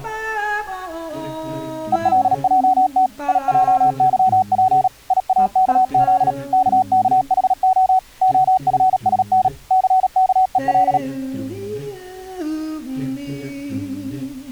Morse code, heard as a keyed tone, machine-sent, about 37 wpm, 750 Hz. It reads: ELJT IJYP IAKZ KKHO OFSN CKEL